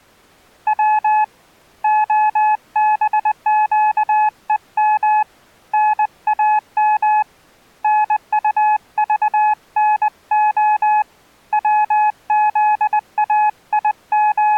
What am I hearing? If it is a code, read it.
Morse code (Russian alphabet), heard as a keyed tone, hand-sent with a paddle, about 20 wpm, 850 Hz. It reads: В ОБЩЕМ НАМ НУЖНО …